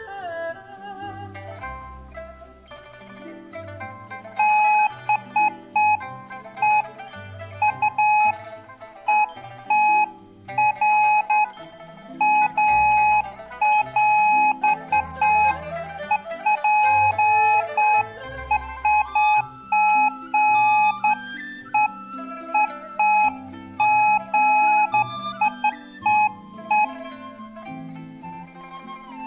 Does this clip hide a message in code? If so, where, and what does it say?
No, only beeps of irregular length, with room echo.